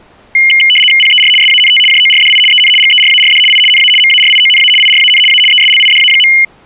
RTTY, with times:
1.0-1.3 PER
1.4-1.8 SANT
1.9-2.4 JORDI
2.5-2.7 EN
2.8-3.4 GERARD
3.5-3.6 I
3.7-3.9 NA
4.0-4.7 MARIONA
4.8-5.2 IRAN
5.3-5.4 A
5.5-6.3 ESLIDA.

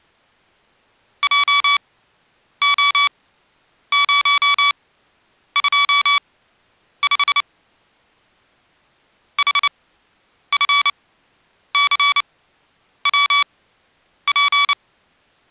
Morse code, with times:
1.2-7.4 JO025
9.4-14.7 HFCWP

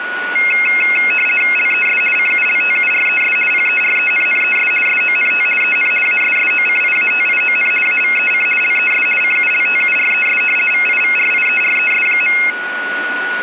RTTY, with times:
1.6-2.0 LES
2.2-3.4 CULTURES
3.5-4.7 PERENNES
4.9-5.5 SONT
5.6-5.9 EN
6.1-7.7 ASSOCIATION
7.9-8.5 AVEC
8.6-9.1 LES
9.2-10.4 CULTURES
10.7-12.4 VIVRIERES.

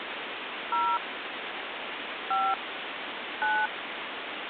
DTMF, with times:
0.7-1.0 0
2.3-2.5 5
3.4-3.7 9

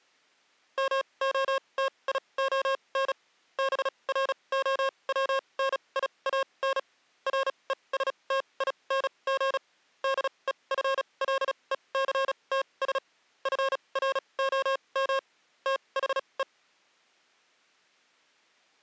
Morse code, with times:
0.8-3.1 MOTION
3.6-6.8 BROWNIAN
7.3-9.6 RESTING
10.0-13.0 DEFLECTS
13.5-15.2 FROM
15.7-16.4 THE

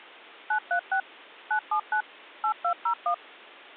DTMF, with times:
0.5-1.0 936
1.5-2.0 979
2.4-3.1 8201

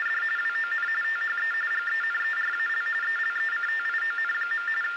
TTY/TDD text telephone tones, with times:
0.0-0.2 …
0.4-0.9 WON
1.0-1.5 THE
1.7-2.9 GENERAL
3.0-4.7 ELECTION.
4.8-5.0 …

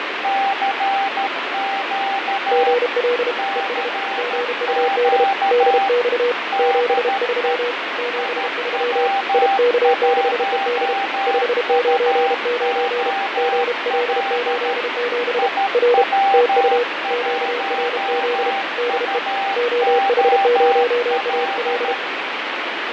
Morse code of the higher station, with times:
0.2-2.7 CQ
3.4-5.9 CQ
6.5-7.5 DE
8.2-14.7 IW1UOL
15.4-21.9 IW1UOL

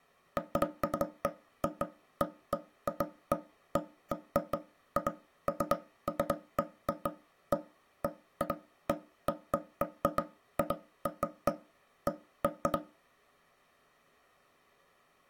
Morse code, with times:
none

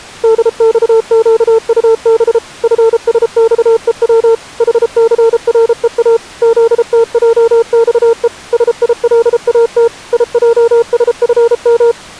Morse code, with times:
0.2-2.4 DXQUB
2.6-4.3 FSXEW
4.6-6.2 HCREA
6.4-8.3 ZTJXE
8.5-9.9 SILAT
10.1-11.9 IJSFM

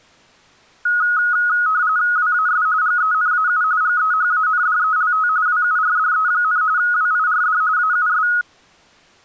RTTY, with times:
2.2-2.7 WAS
2.8-3.6 GENAU
3.8-5.3 GEHANDELT
5.5-6.6 WURDE,
6.8-7.6 WIRD
7.8-8.3 AUS

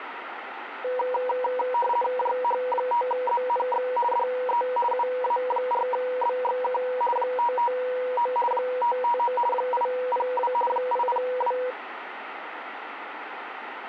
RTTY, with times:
2.2-3.9 JH5ZNX
4.1-4.6 DE
4.9-6.8 UA4BXK
7.2-8.3 559
8.5-9.3 559
9.5-10.5 802
10.7-11.6 802

